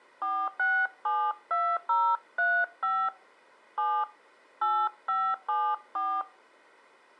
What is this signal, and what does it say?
DTMF, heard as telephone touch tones, dialled by hand, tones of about 260 ms. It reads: 4672035 7 8574